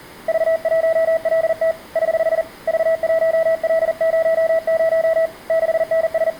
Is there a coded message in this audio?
Yes: Morse code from 0.2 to 6.4 s, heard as a keyed tone, hand-sent with a paddle, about 40 wpm, 650 Hz, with room echo. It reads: V1LT <HH> V1L00 …